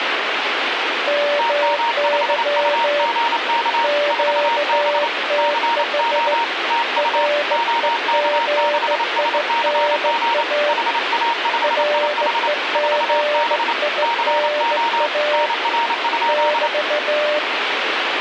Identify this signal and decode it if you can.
Morse code, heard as two keyed tones, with radio static. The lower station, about 16 wpm, 590 Hz: MY QTH REGINA REGINA <BT>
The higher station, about 28 wpm, 930 Hz: TM5UGK 4B CO TU OK6SCG HA5IH 4B CO NR?